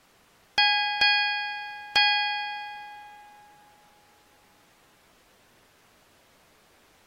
Ship's bell, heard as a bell. 3. Three half-hours of the watch have passed.